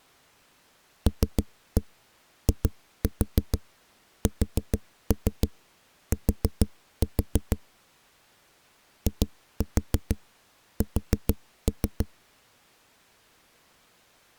Tap code, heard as knocks on a wall, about 6 knocks a second. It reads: LIST IS